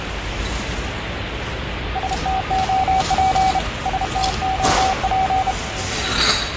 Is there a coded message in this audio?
Yes: Morse code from 1.9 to 5.6 s, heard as a keyed tone, hand-sent with a bug key, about 31 wpm, 760 Hz, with radio static, a weaker station near 1230 Hz and the noise of a residential street. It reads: STOP STOP